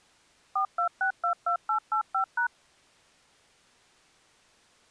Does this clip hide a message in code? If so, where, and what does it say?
Yes: DTMF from 0.6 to 2.5 s, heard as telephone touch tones, dialled by machine, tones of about 100 ms. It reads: 42622885#